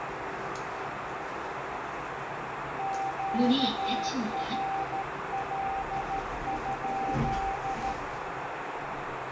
Morse code, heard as a keyed tone, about 13 wpm, 780 Hz, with heavy radio static, a narrow filter and the noise inside a lift. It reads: QRL?